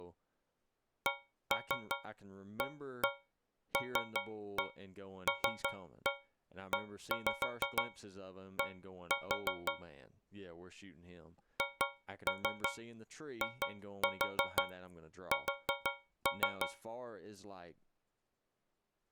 Tap code, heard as taps on a metal pipe, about 6 knocks a second, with speech in English. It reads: CALLED HIS